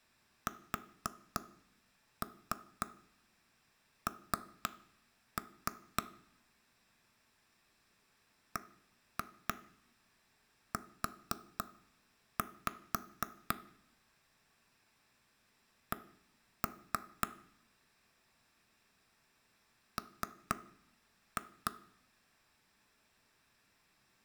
Tap code, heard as knocks on wood, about 3 knocks a second, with room echo. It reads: SN BU C M